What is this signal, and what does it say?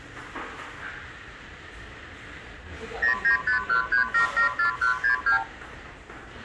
Multi-frequency trunk signalling (R2, with the far end's replies), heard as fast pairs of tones, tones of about 110 ms, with the noise of a restaurant. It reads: 09513774162